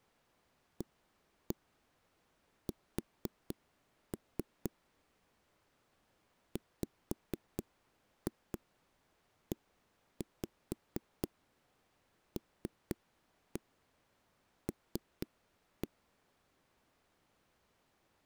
Tap code, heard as knocks on a wall, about 4 knocks a second. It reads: AS WELL